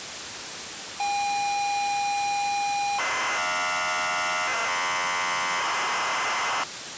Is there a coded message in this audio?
Yes: ZX Spectrum tape loading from 1.0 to 6.6 s, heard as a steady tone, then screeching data, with tape hiss.